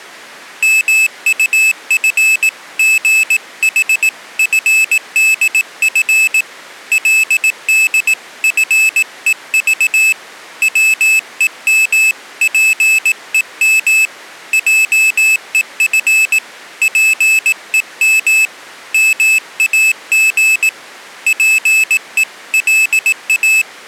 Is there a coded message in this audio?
Yes: Morse code (Korean alphabet) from 0.6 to 23.7 s, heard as a high beeper, hand-sent with a paddle, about 18 wpm, 2600 Hz. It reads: 민수는 그날 밤잠 한 잠 못 자고